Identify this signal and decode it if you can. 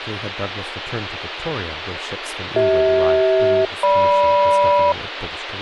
Aircraft SELCAL, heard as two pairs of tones, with radio hiss and speech in English. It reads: CH-GM